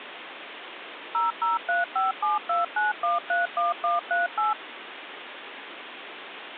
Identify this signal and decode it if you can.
DTMF, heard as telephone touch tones, dialled by machine, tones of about 160 ms, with phone line noise. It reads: 0035729131138